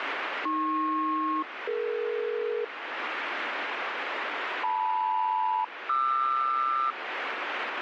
Aircraft SELCAL, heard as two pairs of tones, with radio static. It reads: AP-DE LM-QR